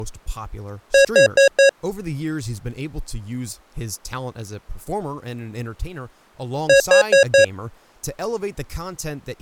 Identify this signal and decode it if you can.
Alarm pattern, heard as an alarm's beeps, played twice, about 550 Hz, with speech in English. Temporal four. Carbon monoxide.